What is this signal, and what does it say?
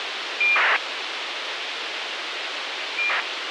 ACARS aircraft data, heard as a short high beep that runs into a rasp, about 2400 baud, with radio hiss.